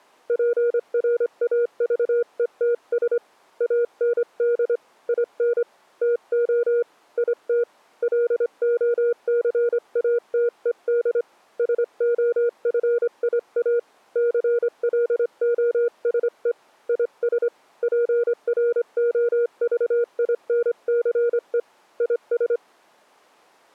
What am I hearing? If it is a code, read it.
Morse code, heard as a keyed tone, hand-sent with a straight key, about 25 wpm, 480 Hz. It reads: PRAVETS AND IN TO IT LOCATED SOFIA CLOSE IS PROVINCE IS